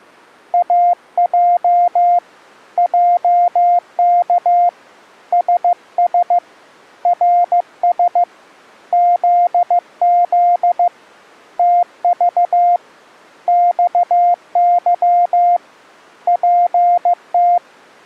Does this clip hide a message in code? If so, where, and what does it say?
Yes: Morse code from 0.5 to 17.6 s, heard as a keyed tone, hand-sent with a paddle, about 15 wpm, 700 Hz. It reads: AJ JK SS RS ZZ TV XY PT